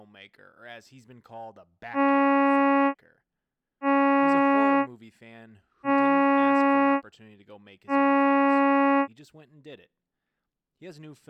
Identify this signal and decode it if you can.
Ship horn signal, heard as a ship's horn, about 280 Hz, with speech in English. 4 short. At sea: a pilot vessel's identity signal in fog.